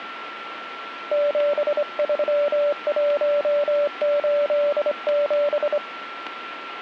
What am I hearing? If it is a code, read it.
Morse code, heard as a keyed tone, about 26 wpm, 580 Hz, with radio static and a steady whistle near 1350 Hz. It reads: 73187